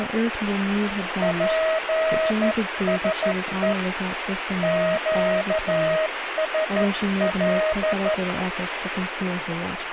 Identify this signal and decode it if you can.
Morse code, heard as a keyed tone, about 13 wpm, 630 Hz, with radio static and speech in English. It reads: PSE QSL